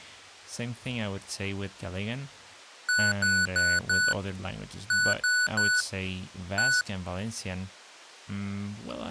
Beep code, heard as beeps from a small speaker, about 1480 Hz, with speech in English. 4-3-1. In Phoenix BIOS tables: memory failure above the first 64 KB.